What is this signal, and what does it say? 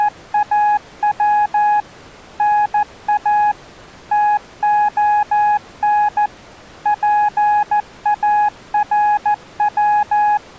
Morse code (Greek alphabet), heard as a keyed tone, machine-sent, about 14 wpm, 840 Hz. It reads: … ΝΑ ΤΟΝ ΠΑΡΩ